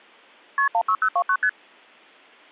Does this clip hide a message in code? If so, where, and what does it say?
Yes: multi-frequency trunk signalling (R1, as on North American trunks) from 0.6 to 1.5 s, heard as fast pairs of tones, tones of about 70 ms. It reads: KP 16029 ST